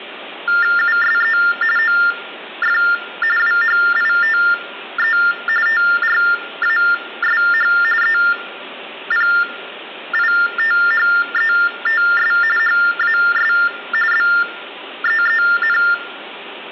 TTY/TDD text telephone tones (45.45 baud Baudot), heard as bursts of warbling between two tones, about 400 Hz shift, 1600 Hz centre, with room echo. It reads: USE OF WHITE TRASH EPITHETS HAS BEEN